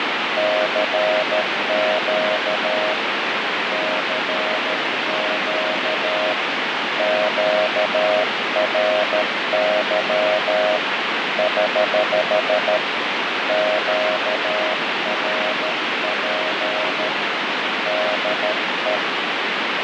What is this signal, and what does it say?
Morse code, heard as a keyed tone, hand-sent with a paddle, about 13 wpm, 630 Hz, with heavy radio static and fading. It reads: CQ CQ QRY <HH> QRP DE